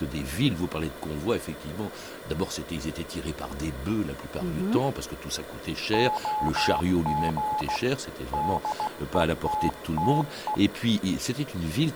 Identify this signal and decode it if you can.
Morse code, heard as a keyed tone, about 16 wpm, 850 Hz, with room echo and speech in French. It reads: OG DETTE